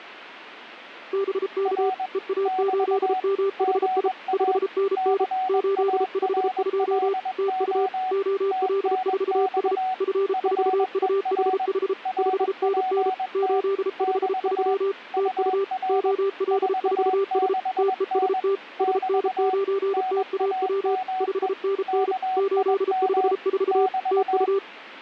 Morse code, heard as two keyed tones. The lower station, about 33 wpm, 390 Hz: BK EA8MHI 5NN 852 TU OL4S F4UHH 5NN 853 TU OL4S TEST SN9TAW 5NN 854 TU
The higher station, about 21 wpm, 750 Hz: R <BT> GA CARLO TNX FER RPT <BT> UR 46N <BT> NAME KIM <BT>